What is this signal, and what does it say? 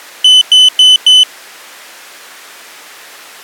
Beep code, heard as a piezo beeper, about 3000 Hz. 4 short. In AMI BIOS tables: system timer failure; in Dell tables: memory read or write failure.